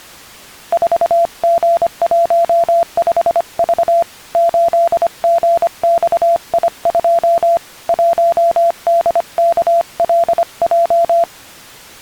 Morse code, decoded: 4G15V 8GXI2 1DKLJ

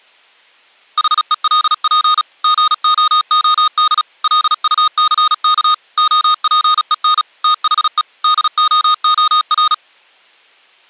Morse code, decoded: HELP GOOD LUCK OPEN THE DOOR

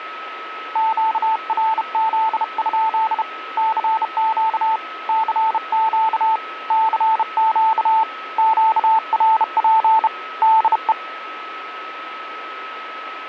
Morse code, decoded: QRZ? CQ CQ CQ QRP DE

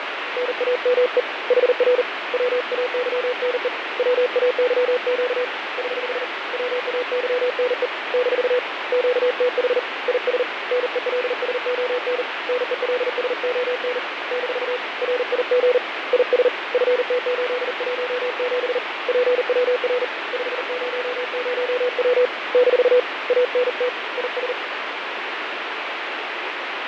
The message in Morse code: NAME HR WAYNE WAYQ <HH> WAYNE - QTH IS NELSON NELSON - RIG IS FT817 PWR 500W - ANT IS

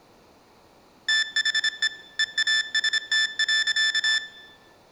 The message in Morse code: THE EAST.

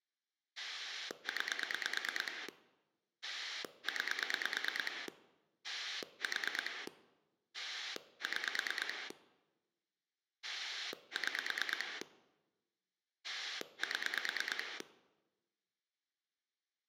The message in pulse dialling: 9 9 4 6 6 7

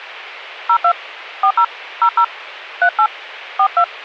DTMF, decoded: 02 40 00 38 42

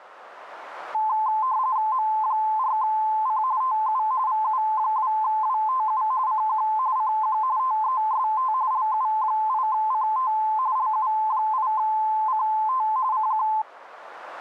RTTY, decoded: M4C TU VU2WTU CQ CQ TEST LU8CT LU8CT CQ

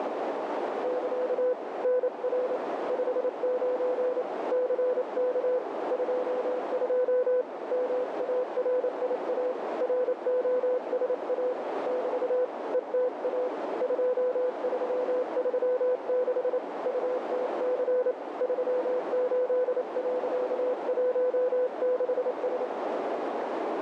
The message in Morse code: <KA> NR 59 CK 22 MARIA ROSA <BT> ETA 2336 UTC 38.16S

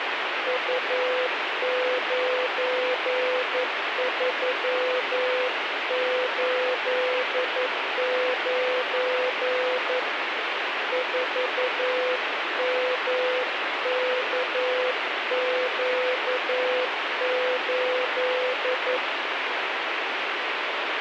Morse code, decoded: U9389 4MKQ8

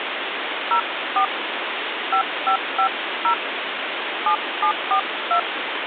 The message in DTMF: 04 5550 7742

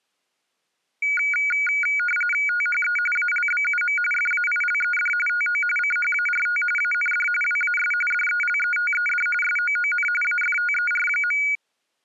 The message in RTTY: THE ALBUM FAILED TO CHART AND WAS DELETED SOON AFTER.

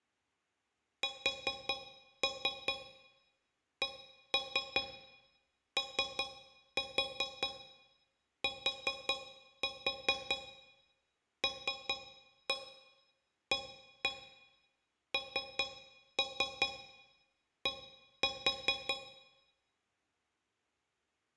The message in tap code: SCOTLAND

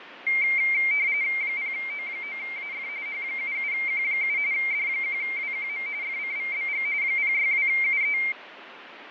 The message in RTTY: 0O9AF H77Q7 D1WQM FCVBG 062UE

